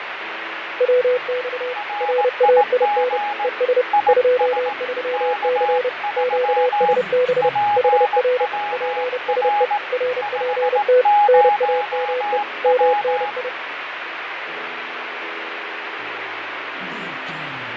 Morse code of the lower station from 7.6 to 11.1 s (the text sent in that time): HR PSE RPT